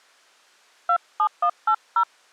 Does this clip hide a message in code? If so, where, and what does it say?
Yes: DTMF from 0.9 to 2.0 s, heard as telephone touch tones, dialled by hand, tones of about 80 ms. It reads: 27180